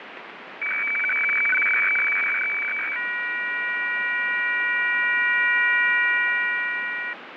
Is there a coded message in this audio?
Yes: weather fax (radiofax), 120 lines a minute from 0.6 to 7.1 s, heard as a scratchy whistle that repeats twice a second, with radio static and fading.